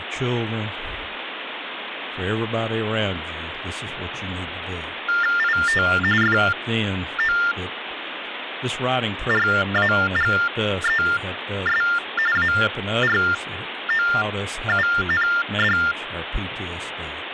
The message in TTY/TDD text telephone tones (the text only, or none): IT FORAGES AROUND